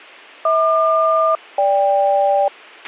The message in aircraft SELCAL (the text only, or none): HQ-GK